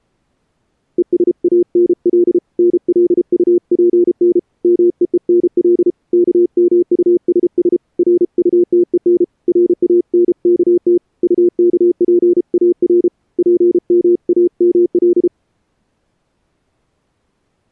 Morse code, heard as a keyed tone, hand-sent with a paddle, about 33 wpm, 350 Hz. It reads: ESANL NLUPN MEENL KMUSS RUTEN RANKT UKPAR PMAML